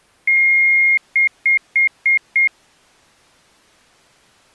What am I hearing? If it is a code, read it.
Beep code, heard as beeps, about 2150 Hz. 1 long, 5 short.